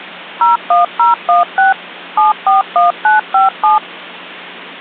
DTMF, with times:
0.4-1.7 01016
2.2-3.8 741957

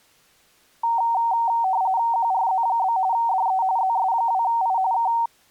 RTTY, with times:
2.1-3.0 QRZ?
3.1-3.6 DE
3.8-4.8 ZS2I
4.9-5.1 K

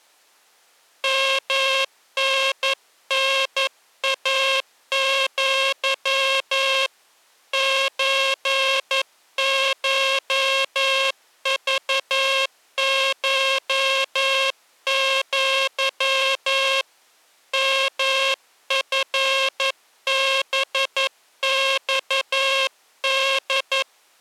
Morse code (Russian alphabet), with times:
1.0-6.9 МННАЪ
7.5-16.8 ЧШЖШЪ
17.5-23.8 МФБЬД

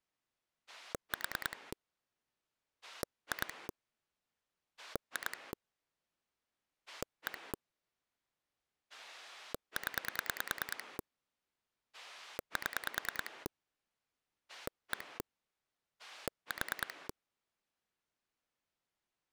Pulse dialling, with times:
0.7-1.7 4
2.8-3.7 2
4.8-5.5 2
6.9-7.5 1
8.9-11.0 0
11.9-13.5 7
14.5-15.2 1
16.0-17.1 4

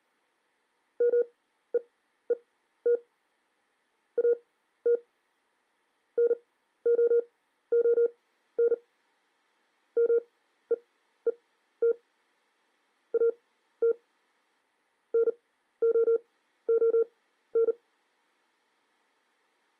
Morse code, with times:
1.0-3.0 MEET
4.2-4.9 AT
6.2-8.7 NOON
10.0-11.9 MEET
13.1-13.9 AT
15.1-17.7 NOON

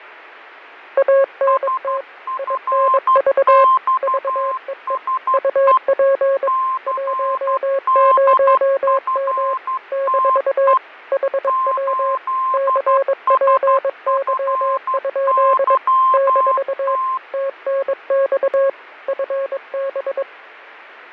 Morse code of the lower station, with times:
1.0-2.0 ANT
2.4-3.6 INV
4.0-5.0 VEE
5.3-6.5 UP
6.9-9.5 10M
9.9-10.7 -
11.1-12.2 HW
12.5-15.8 CPY?
16.1-17.0 -
17.3-18.7 TNX
19.1-20.2 FB

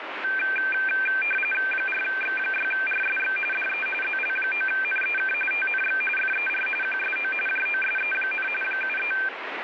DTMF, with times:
none

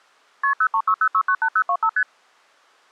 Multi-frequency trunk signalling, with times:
0.4-0.5 KP
0.6-1.9 0360698025
2.0-2.0 ST

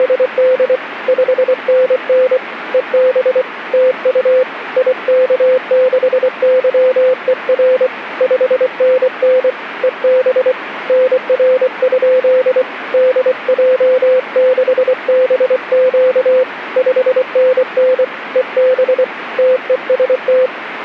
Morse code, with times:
0.0-0.8 …
1.1-2.4 5NN
2.7-3.4 EB
3.7-4.4 TU
4.8-7.9 IK6YER
8.2-9.5 5NN
9.8-10.5 EB
10.9-12.6 NR?
12.9-16.4 DJ6BQ
16.8-18.0 5NN
18.4-19.0 EB
19.4-20.5 TEST

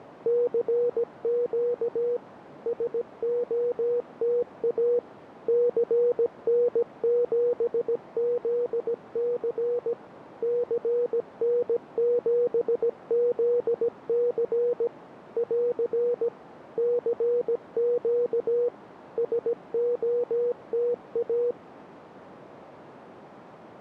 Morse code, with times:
0.3-2.2 CQ
2.7-5.0 SOTA
5.5-9.9 CN7ZC
10.4-14.9 CN7ZC
15.4-16.3 <AR>
16.8-18.7 CQ
19.2-21.5 SOTA

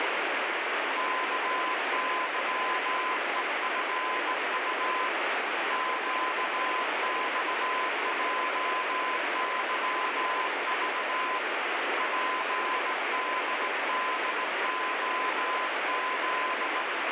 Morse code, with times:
1.0-5.1 KYEFU
5.7-11.4 QXJYV
12.0-16.8 PDDOZ

